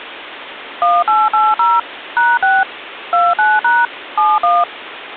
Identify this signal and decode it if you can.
DTMF, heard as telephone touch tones, dialled by machine, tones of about 210 ms, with phone line noise. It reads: 1880 #6 29# 71